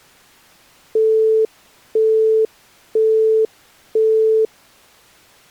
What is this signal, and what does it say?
Telephone call progress tone (single-tone plan, as in Europe, Japan and elsewhere), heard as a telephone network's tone, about 440 Hz, 0.5 s on and 0.5 s off. Busy tone.